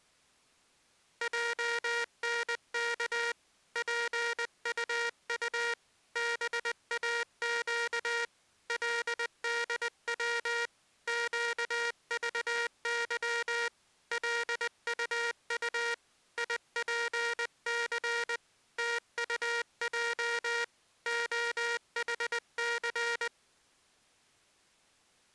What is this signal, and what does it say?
Morse code, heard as a buzzer, hand-sent with a paddle, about 20 wpm. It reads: JNK PUU BAQ LDW QVY LUU IPC TUJ OHC